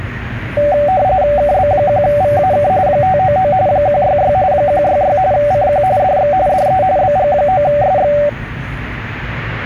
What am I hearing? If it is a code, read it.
RTTY (45.45 baud, 170 Hz shift), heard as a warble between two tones, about 670 Hz centre, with the noise of a cafe. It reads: KB1VAK 599 166 166 CQ DX DE BG9SX